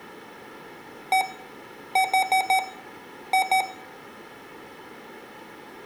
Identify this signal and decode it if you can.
Beep code, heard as beeps from a small speaker, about 760 Hz, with room echo. 1-4-2. In Phoenix BIOS tables: parity failure in the first 64 KB of memory.